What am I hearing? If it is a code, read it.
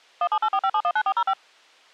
DTMF, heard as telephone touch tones, dialled by machine, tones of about 60 ms. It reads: 17845719405